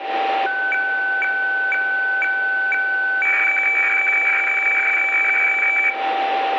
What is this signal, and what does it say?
Weather fax (radiofax), 120 lines a minute, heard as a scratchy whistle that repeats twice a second, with radio static, a steady whistle near 780 Hz and room echo.